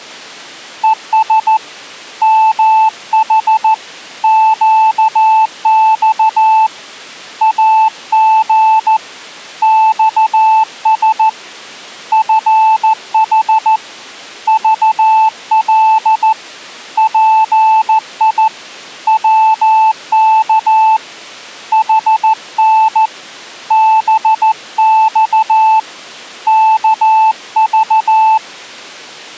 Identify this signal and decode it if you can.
Morse code, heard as a keyed tone, hand-sent with a paddle, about 14 wpm, 880 Hz. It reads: ES MH QX AG XS FH VL PI WK HN BX KV